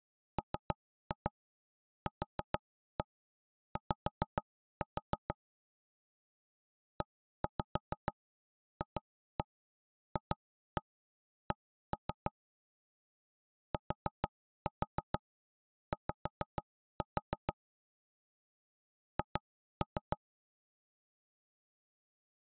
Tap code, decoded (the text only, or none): MQY EFFC TY H